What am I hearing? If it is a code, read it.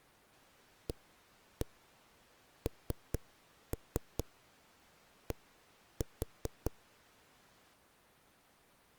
Tap code, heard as knocks on a wall, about 4 knocks a second. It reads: AND